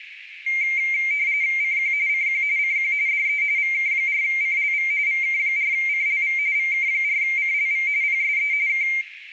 RTTY (45.45 baud, 170 Hz shift), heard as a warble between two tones, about 2200 Hz centre, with radio static and room echo. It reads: CQ CQ CQ DE VK4CLV VK4CLV VK4CLV PSE K